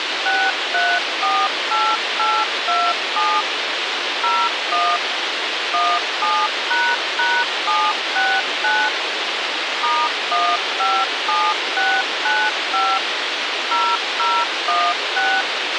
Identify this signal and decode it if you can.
DTMF, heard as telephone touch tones, dialled by machine, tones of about 240 ms, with radio hiss and a squelch burst at the end. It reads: 6348827 01 17##769 *157695 0016